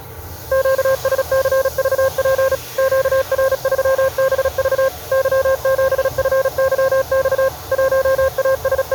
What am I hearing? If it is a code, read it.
Morse code, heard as a keyed tone, machine-sent, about 36 wpm, 530 Hz, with the noise of a restroom. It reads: QSCVP QR3BV Y7FYX …